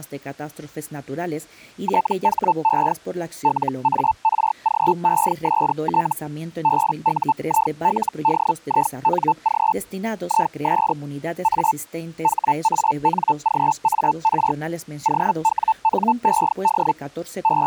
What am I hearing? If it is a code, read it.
Hellschreiber (Feld-Hell, 122.5 baud), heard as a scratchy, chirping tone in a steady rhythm, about 880 Hz. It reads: THE LARGEST BUILDING IS A HANGAR OWNED …